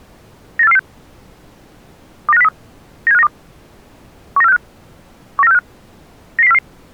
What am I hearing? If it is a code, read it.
Five-tone selective call (EEA), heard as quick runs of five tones, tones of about 40 ms. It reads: 98446 29503 97592 19465 19465 99044